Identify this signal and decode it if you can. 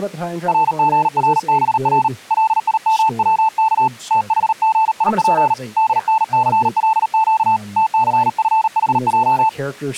Morse code, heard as a keyed tone, hand-sent with a paddle, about 38 wpm, 880 Hz, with speech in English. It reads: RGRBR LIMWK THGIP DNCLQ TCFHJ